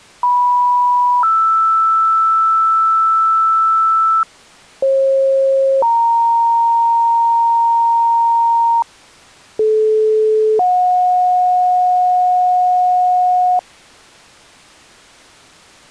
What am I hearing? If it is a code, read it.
Two-tone page, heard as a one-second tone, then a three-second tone, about 980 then 1320 Hz, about 540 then 930 Hz, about 430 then 730 Hz.